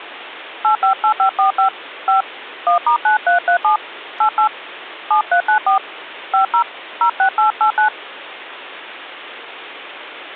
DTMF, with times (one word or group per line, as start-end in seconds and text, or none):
0.6-1.7 858545
2.1-2.2 5
2.7-3.8 1*9337
4.2-4.5 88
5.1-5.8 7394
6.3-6.6 50
7.0-7.9 06889